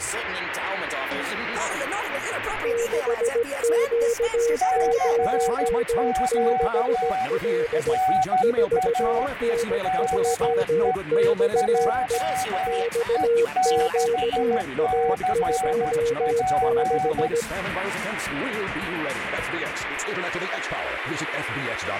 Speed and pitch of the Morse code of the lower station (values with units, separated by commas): 17 wpm, 470 Hz